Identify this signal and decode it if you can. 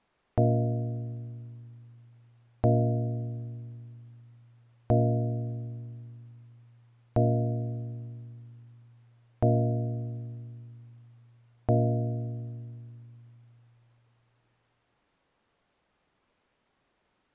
Clock strike, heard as a bell. 6. Six o'clock.